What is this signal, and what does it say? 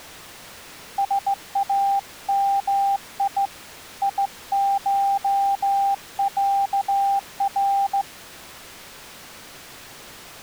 Morse code (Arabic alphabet), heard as a keyed tone, hand-sent with a straight key, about 16 wpm, 790 Hz. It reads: سامي يشعر